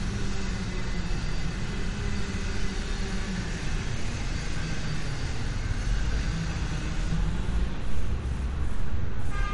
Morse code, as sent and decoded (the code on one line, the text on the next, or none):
none